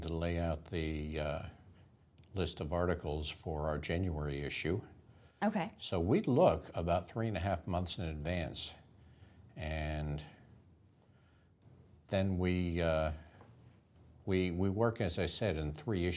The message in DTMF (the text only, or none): none